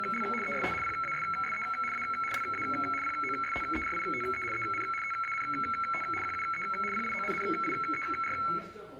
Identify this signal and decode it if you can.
RTTY (75 baud, 850 Hz shift), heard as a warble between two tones, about 1750 Hz centre, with room echo and the noise of a restaurant. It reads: … EST PASSE A LA POSTERITE EN TANT QUE PIONNIER